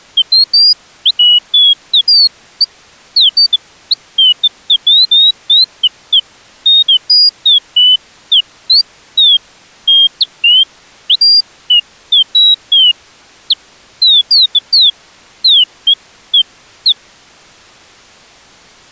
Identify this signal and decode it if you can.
Bird-like chirps. There is no code.